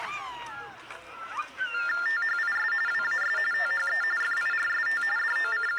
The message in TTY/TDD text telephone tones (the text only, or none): THIS WAS THE FIRST …